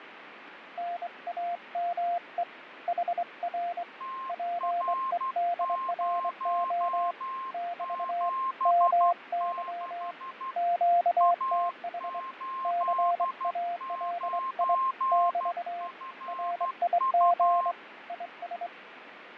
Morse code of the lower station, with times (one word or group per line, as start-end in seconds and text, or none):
0.8-2.4 NAME
2.9-3.8 HR
4.3-7.1 PEDRO
7.5-8.3 <BT>
8.7-10.1 MY
10.6-12.2 QTH
12.6-14.7 CALI
15.1-15.9 <BT>
16.3-17.7 RIG
18.1-18.7 IS